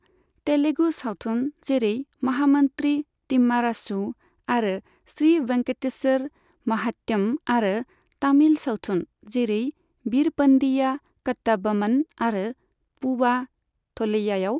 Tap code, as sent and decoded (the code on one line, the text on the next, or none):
none